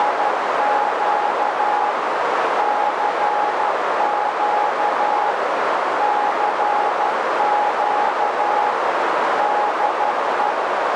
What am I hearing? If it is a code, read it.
Morse code, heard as a keyed tone, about 12 wpm, 830 Hz, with heavy radio static and a narrow filter. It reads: … CQ CQ DE